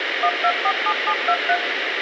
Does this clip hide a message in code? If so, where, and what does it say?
Yes: DTMF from 0.2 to 1.6 s, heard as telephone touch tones, dialled by machine, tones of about 70 ms, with radio hiss. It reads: 1247723